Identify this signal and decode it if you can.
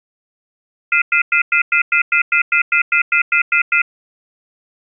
Telephone call progress tone (North American plan), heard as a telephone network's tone, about 1400, 2050, 2450, 2600 Hz, 0.1 s on and 0.1 s off. Off-hook warning tone.